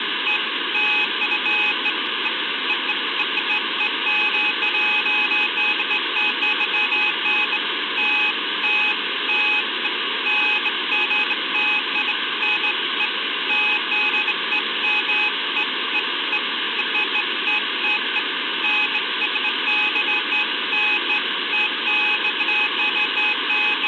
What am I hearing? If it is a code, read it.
Beeps of irregular length, with phone line noise. There is no code.